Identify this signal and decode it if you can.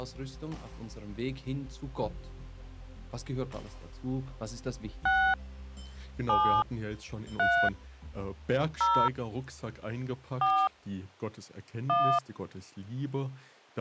DTMF, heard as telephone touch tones, dialled by hand, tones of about 280 ms. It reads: 6 7 3 0 4 1